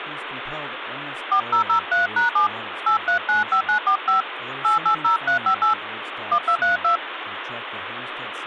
DTMF, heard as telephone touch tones, dialled by hand, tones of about 110 ms, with phone line noise and speech in English. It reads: 4003#7 8395945 880358 1232